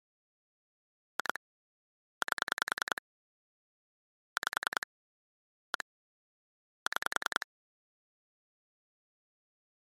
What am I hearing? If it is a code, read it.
Pulse dialling, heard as clicks on a phone line, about 10 pulses a second. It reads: 2 8 5 1 6